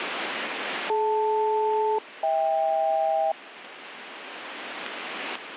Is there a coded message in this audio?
Yes: aircraft SELCAL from 0.9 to 3.3 s, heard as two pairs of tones. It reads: DL-HK